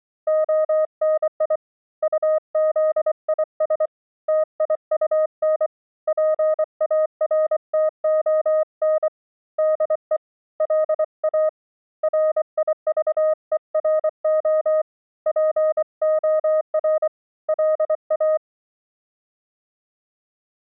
Morse code, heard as a keyed tone, hand-sent with a bug key, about 24 wpm, 620 Hz. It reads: ONI UZIS TIUN PARTON DE LA RIVERO POR LA